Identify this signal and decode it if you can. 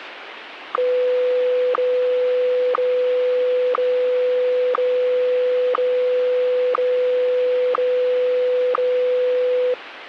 Radio time signal (WWVH, Hawaii), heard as ticks, one a second, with radio static.